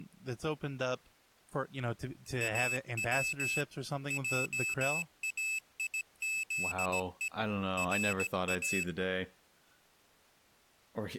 Morse code (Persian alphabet), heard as a high beeper, machine-sent, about 17 wpm, 2600 Hz, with speech in English. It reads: او جایزه را